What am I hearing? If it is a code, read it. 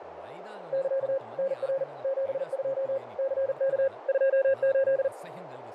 Morse code, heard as a keyed tone, machine-sent, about 40 wpm, 540 Hz, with radio static, fading, a narrow filter and speech in Telugu. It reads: <KA> NR 72 CK 28